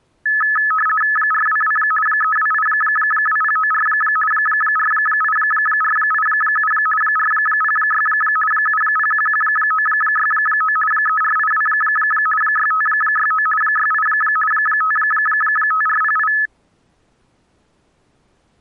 RTTY (50 baud, 450 Hz shift), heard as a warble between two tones, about 1500 Hz centre. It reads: 422 3282094 48487 406 7011969 3482 6569 68 55408